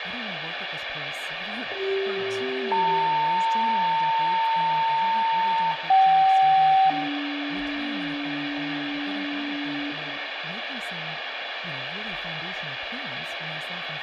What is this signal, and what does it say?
Two-tone page, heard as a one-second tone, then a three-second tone, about 390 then 900 Hz, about 770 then 290 Hz, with radio hiss, room echo and speech in English.